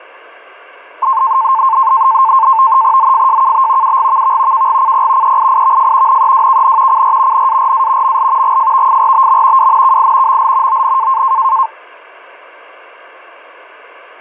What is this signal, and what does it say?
NAVTEX (SITOR-B), 100 baud, 170 Hz shift, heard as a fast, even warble, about 980 Hz centre. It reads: ZFJKB UGVV KGCP EIIVF NEWKN CR NARA ML GFVFRBM WNKI ML ON